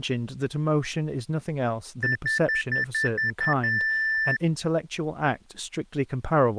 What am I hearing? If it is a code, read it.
Beep code, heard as beeps, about 1750 Hz, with speech in English. 7 short, 1 long.